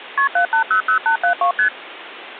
Multi-frequency trunk signalling (R1, as on North American trunks), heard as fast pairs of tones, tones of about 100 ms. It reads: KP 7800872 ST